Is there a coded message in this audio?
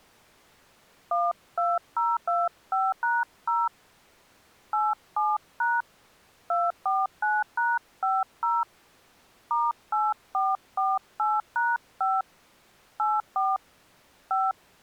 Yes: DTMF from 1.1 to 14.5 s, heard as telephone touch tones, dialled by hand, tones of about 200 ms. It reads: 12025#0 87# 249#50 *8448#5 84 5